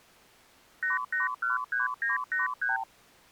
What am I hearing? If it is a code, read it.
Multi-frequency trunk signalling (R2, with the far end's replies), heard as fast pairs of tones, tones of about 150 ms. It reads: 8813983